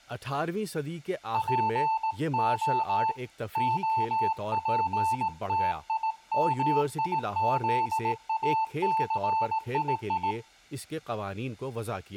Morse code (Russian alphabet), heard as a keyed tone, hand-sent with a paddle, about 18 wpm, 890 Hz, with speech in Urdu. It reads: ПО ОПТИМИЗАЦИИ